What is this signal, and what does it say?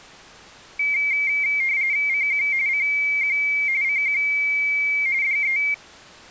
RTTY (45.45 baud, 170 Hz shift), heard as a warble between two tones, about 2200 Hz centre. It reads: CQ CQ CQ DE